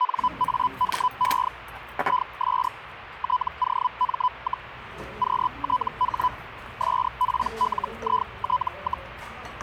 Hellschreiber (Feld-Hell, 122.5 baud), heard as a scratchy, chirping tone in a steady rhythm, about 1000 Hz, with radio static and the noise of a restaurant. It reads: NAME IS TOM, QTH SPLIT,